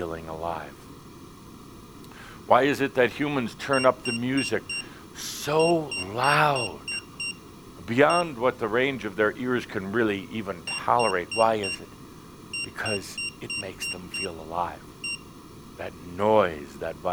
Beep code, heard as a piezo beeper, played twice, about 2750 Hz, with room echo and speech in English. 4-6-1.